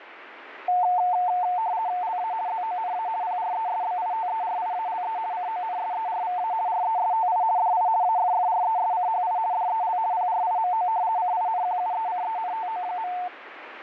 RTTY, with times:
2.0-2.3 LA
2.5-3.1 ZONA
3.2-5.2 PRESBITERIALE
5.3-6.5 CONSERVA
6.7-7.4 RESTI
7.6-7.9 DI
8.0-9.4 AFFRESCHI
9.5-10.0 DEL
10.1-10.9 PRIMO
11.2-13.1 CINQUECENTO.

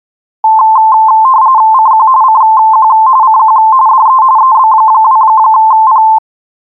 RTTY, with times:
1.7-2.1 CQ
2.2-2.9 CQ
3.2-3.6 CQ
3.9-4.2 DE
4.4-6.0 EB2P

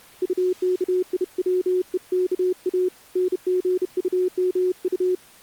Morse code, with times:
0.2-2.9 UKIWEKA
3.2-5.1 NGUMU

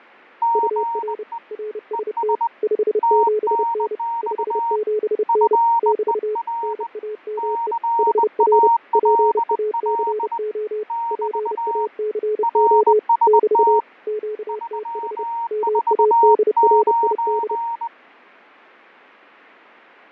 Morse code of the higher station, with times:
0.4-1.4 GE
1.9-2.5 ES
3.0-4.8 TNX
5.3-6.9 FER
7.4-10.4 CALL
10.9-11.9 <BT>
12.4-13.8 RST
14.5-17.9 349

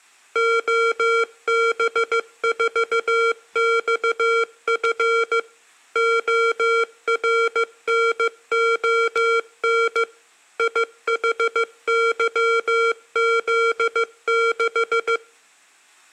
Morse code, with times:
0.4-5.4 OB4XF
6.0-10.0 ORNON
10.6-15.2 IHYZ6

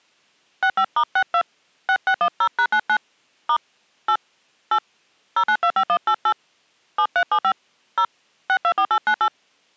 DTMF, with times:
0.6-1.4 65*62
1.9-3.0 6610#99
3.5-3.6 *
4.1-4.2 8
4.7-4.8 8
5.4-6.3 0925188
7.0-7.5 7375
8.0-8.0 0
8.5-9.3 624898

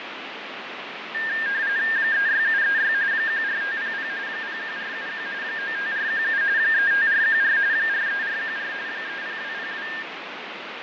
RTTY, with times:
2.0-2.9 36736
3.1-4.1 14500
4.3-5.3 01471
5.4-6.4 95417
6.6-7.6 35414
7.7-8.7 43414
8.9-9.9 30202

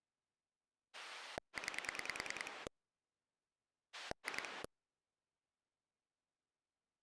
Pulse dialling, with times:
0.9-2.7 9
3.9-4.6 2

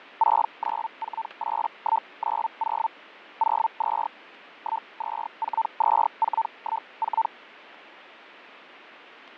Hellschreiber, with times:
0.2-2.9 6948190
3.4-4.1 02
4.6-7.3 1242414

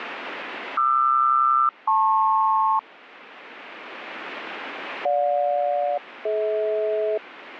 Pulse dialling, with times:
none

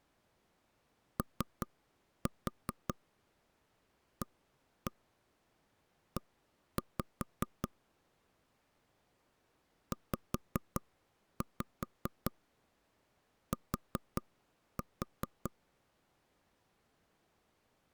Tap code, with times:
1.2-7.7 OAE
9.9-15.5 ZT

